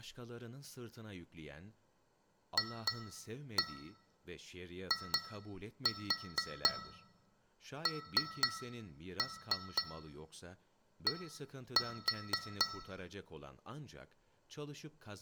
Tap code, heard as taps on glass, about 4 knocks a second, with room echo and speech in Turkish. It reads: FIND